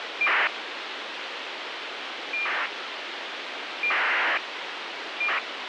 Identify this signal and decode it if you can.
ACARS aircraft data, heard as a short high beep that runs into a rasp, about 2400 baud, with radio hiss.